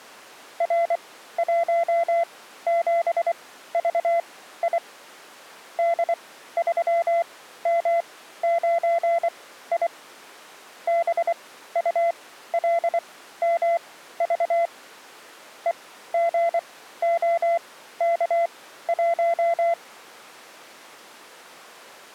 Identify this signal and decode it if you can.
Morse code, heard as a keyed tone, machine-sent, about 24 wpm, spaced as for 14 wpm, 680 Hz. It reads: R17VI D3M9I BULMV EGOK1